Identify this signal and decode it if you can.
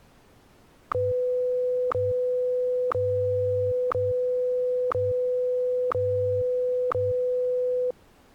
Radio time signal (WWVH, Hawaii), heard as ticks, one a second.